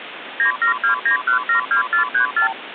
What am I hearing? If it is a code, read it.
Multi-frequency trunk signalling (R2, with the far end's replies), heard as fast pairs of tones, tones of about 110 ms, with phone line noise. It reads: 9729172434